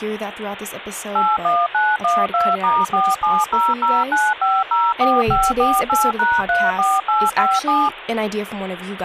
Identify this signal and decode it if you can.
DTMF, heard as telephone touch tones, dialled by machine, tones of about 220 ms, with phone line noise and speech in English. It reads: 81912*47009504548#34857